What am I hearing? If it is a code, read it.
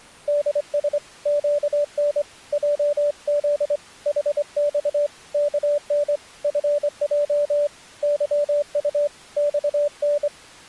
Morse code, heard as a keyed tone, hand-sent with a straight key, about 24 wpm, 580 Hz. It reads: DS QN JZ HX KN FJ YU XN